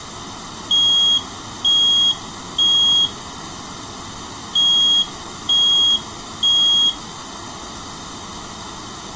Alarm pattern, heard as an alarm's beeps, played twice, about 3300 Hz, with room echo. Temporal three. Smoke or fire, evacuate.